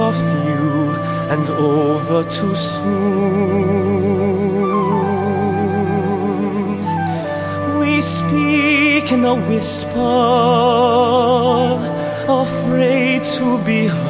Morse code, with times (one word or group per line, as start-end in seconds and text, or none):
none